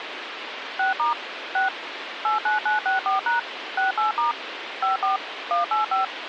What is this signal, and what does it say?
DTMF, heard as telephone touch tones, dialled by machine, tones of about 140 ms, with phone line noise. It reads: 6* 6 89964# 68* 54 185